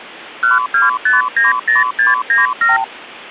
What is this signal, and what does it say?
Multi-frequency trunk signalling (R2, with the far end's replies), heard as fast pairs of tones, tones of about 160 ms. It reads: 12590697